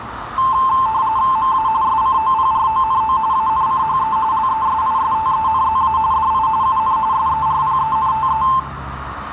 RTTY (45.45 baud, 170 Hz shift), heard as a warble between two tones, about 970 Hz centre, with radio static, a narrow filter, room echo and street noise. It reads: MA SCOPRONO ANCHE LESISTENZA DI UN SERPENTE